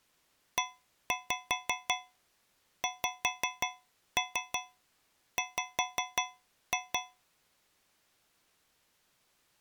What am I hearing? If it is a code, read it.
Tap code, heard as taps on a metal pipe, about 5 knocks a second. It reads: EXW